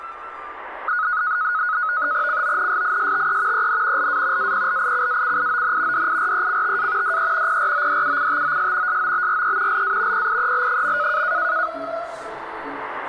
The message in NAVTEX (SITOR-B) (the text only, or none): CONSISTE EN LA APLICACION DIRECTA DE PRODUCTOS SOBRE LA PIEL.